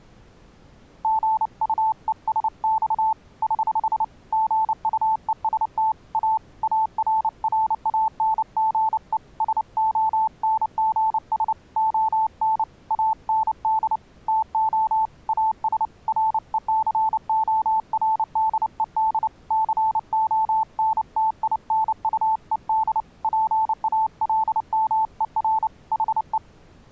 Morse code, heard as a keyed tone, hand-sent with a paddle, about 29 wpm, 880 Hz. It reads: GUESX <HH> GUEST A ARRANGE SONGS ON AND TO AS RECORDED CONTINUED PALMER HE